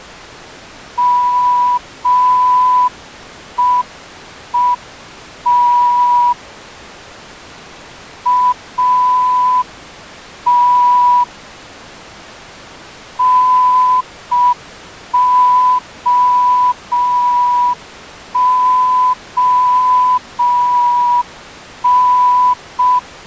Morse code, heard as a whistle, hand-sent with a straight key, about 5 wpm. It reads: MEET AT NOON